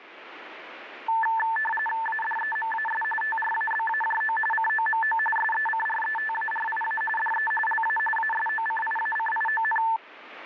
RTTY (45.45 baud, 850 Hz shift), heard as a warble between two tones, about 1320 Hz centre, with radio static. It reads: ADEMAS TRABAJO COMO SECRETARIA DE LA ASOCIACION